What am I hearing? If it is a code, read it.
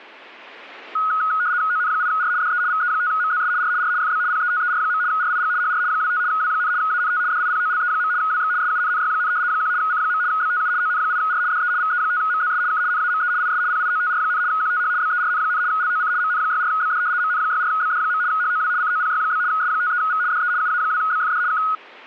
RTTY (75 baud, 170 Hz shift), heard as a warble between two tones, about 1360 Hz centre. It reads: ON8R DE VE5MZS R R FB PETER. RIG HR 25 W, ANT DIPOLE. WX SUNNY, 1 C. BTU ON8R DE VE5MZS K NAME IS PIOTR, QTH BERN, LOC MN64BD MN64BD. HOW COPY? S53V DE UA2BFD K